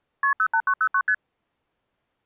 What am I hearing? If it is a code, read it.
Multi-frequency trunk signalling (R1, as on North American trunks), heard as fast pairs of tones, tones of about 70 ms. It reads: KP 08909 ST